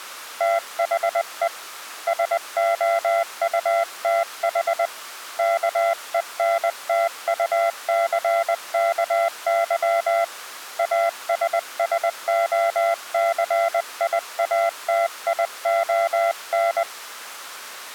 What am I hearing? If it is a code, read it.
Morse code, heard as a keyed tone, hand-sent with a paddle, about 20 wpm, 680 Hz. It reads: THE SOUTH KENTUCKY ASSOCIATION